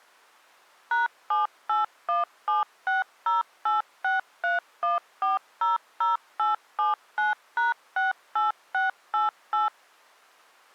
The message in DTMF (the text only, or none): #7817608631400879#68688